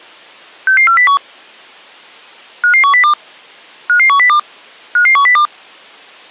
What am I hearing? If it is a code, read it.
Five-tone selective call (CCIR), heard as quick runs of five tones, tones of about 100 ms. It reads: 66401 55102 55102 55102